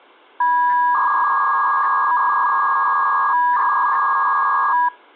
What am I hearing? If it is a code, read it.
300-baud modem data (V.21 tones), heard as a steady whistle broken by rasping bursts, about 300 baud, 200 Hz shift.